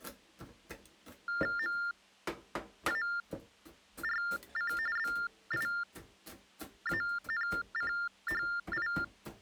TTY/TDD text telephone tones (45.45 baud Baudot), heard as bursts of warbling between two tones, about 400 Hz shift, 1600 Hz centre, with kitchen noise. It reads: MARC BIANCHI